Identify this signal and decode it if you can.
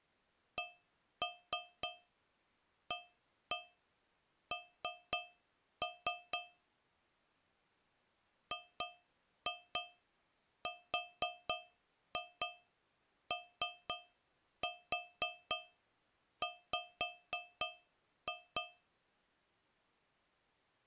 Tap code, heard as taps on a metal pipe, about 3 knocks a second. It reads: CAN GROW